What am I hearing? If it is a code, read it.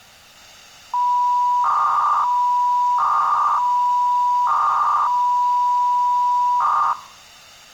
300-baud modem data (V.21 tones), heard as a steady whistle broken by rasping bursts, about 300 baud, 200 Hz shift.